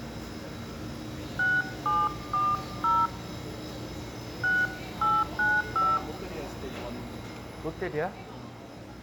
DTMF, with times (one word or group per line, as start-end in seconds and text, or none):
1.4-3.1 6740
4.4-6.0 6895